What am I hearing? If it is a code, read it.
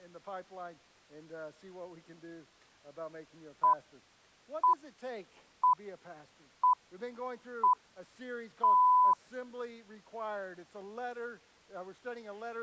Radio time signal (six pips, as the Greenwich Time Signal), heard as pips.